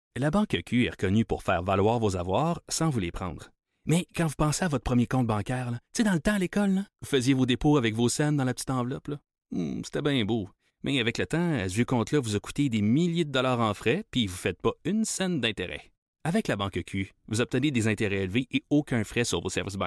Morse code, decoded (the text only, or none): none